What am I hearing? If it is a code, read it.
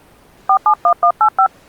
DTMF, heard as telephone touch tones, dialled by hand, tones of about 80 ms. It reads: 471185